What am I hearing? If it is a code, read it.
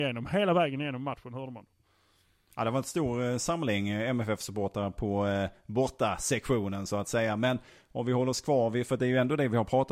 Speech in Swedish. There is no code.